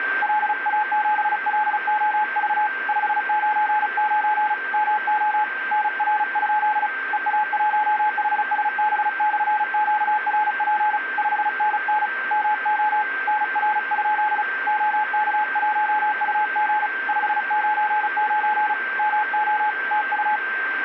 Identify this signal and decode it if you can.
Morse code, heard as a keyed tone, hand-sent with a paddle, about 35 wpm, 850 Hz, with radio static and a steady whistle near 1570 Hz. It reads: LA7LOV 599 MO NR? EA1HSB/QRP 5NN MO NR? OK1UG 599 MO TU